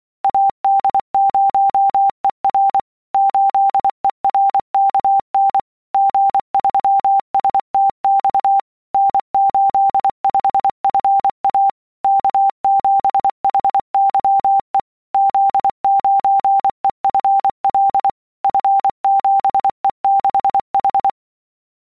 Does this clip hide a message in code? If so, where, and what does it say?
Yes: Morse code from 0.2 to 21.2 s, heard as a keyed tone, machine-sent, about 24 wpm, 790 Hz. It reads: AD0ER 8ERKN G3STX N85FA K7HYE Z9EFL F7E6H